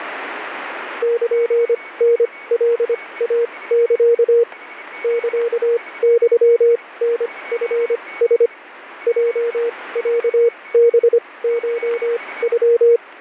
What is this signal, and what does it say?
Morse code (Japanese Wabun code), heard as a keyed tone, machine-sent, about 25 wpm, spaced as for 19 wpm, 470 Hz, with radio static, static crashes and a weaker station near 2230 Hz. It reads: ルタカイサ サユタチラ ヲロハコノ